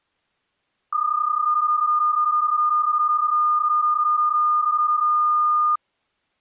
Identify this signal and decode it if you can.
PSK31 (31.25 baud), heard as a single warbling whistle, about 1220 Hz.